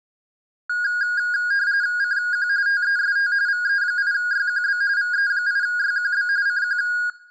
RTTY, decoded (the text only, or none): CQ TEST VE8YQB VE8YQB CQ